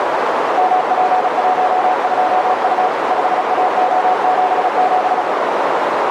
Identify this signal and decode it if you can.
Morse code, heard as a keyed tone, machine-sent, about 36 wpm, 740 Hz, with heavy radio static and a narrow filter. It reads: MP12U 5AO77